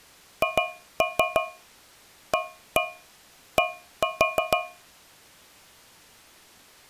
Tap code, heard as taps on a metal pipe, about 6 knocks a second. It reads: HAD